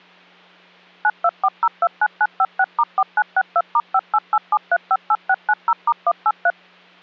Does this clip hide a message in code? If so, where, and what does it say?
Yes: DTMF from 1.0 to 6.5 s, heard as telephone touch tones, dialled by machine, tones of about 50 ms, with hum. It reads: 924029956*4962*5887358690*183